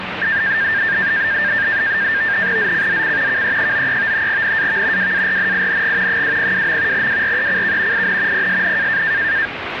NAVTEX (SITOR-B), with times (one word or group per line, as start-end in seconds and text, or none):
2.6-3.4 ZCZC
3.3-4.3 KE93
4.3-5.1 NAV
5.0-6.2 WARNING
6.1-7.1 202.
6.9-8.1 WRECK
7.9-8.5 IN
8.3-9.0 PSN